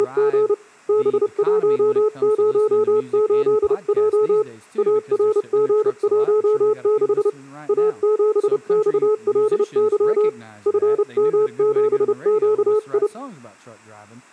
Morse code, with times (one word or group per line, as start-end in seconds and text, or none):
0.0-0.5 …
0.9-4.4 B108J
4.8-7.3 ARG16
7.7-10.3 A7XLY
10.7-13.1 FM7QI